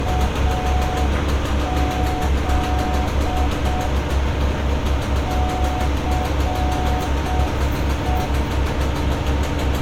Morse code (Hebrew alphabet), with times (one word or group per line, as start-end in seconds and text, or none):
0.1-3.9 אז
5.3-8.3 סו